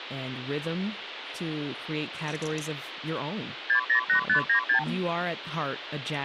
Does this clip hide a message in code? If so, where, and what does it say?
Yes: multi-frequency trunk signalling (R2, with the far end's replies) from 3.7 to 4.8 s, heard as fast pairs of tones, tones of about 100 ms, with phone line noise and speech in English. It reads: 608596